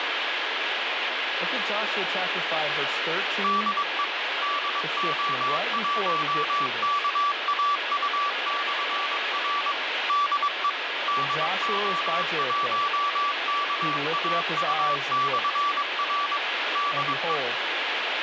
Morse code, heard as a keyed tone, machine-sent, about 22 wpm, 1160 Hz, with heavy radio static and speech in English. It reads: DE DO1KAU/R DE DO1KAU/R DE